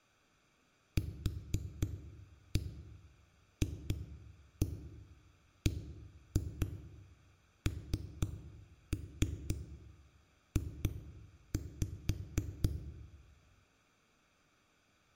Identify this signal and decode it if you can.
Tap code, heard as knocks on a wall, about 4 knocks a second, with room echo. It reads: QFBNJ